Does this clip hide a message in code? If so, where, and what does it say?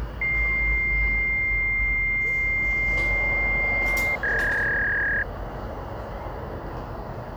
Yes: fax machine handshake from 0.2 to 5.2 s, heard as a long tone and a warble, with the noise of a residential street.